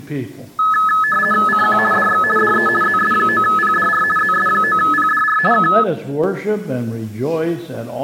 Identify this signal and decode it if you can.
RTTY (50 baud, 450 Hz shift), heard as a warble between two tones, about 1500 Hz centre. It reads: CQ DX DE ZS9PDR ZS9PDR K